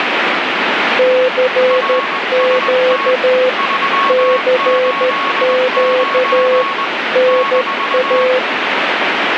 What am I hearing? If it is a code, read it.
Morse code, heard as two keyed tones, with radio static. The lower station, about 13 wpm, 510 Hz: CQ CQ NA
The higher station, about 20 wpm, 1100 Hz: RST 389 -